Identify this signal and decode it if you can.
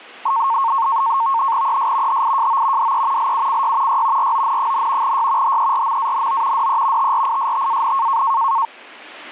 NAVTEX (SITOR-B), 100 baud, 170 Hz shift, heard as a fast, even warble, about 1000 Hz centre. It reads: ES HIJO DE LUCY Y RON, Y HERMANO DE TRISTAN